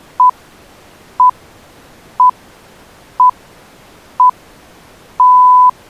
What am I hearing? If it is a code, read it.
Radio time signal (six pips, as the Greenwich Time Signal), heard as pips.